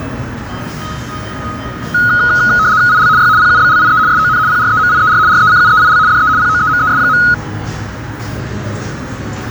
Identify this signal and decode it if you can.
RTTY (75 baud, 170 Hz shift), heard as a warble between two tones, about 1360 Hz centre, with radio static and the noise of a cafe. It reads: IL Y PUBLIE SON PREMIER RECUEIL DE POEMES.